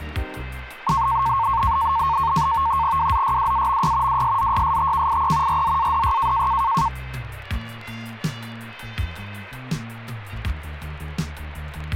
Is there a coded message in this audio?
Yes: NAVTEX (SITOR-B), 100 baud, 170 Hz shift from 0.9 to 6.9 s, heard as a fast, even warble, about 1000 Hz centre. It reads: WZYWAMY WSZYSTKIE RZADY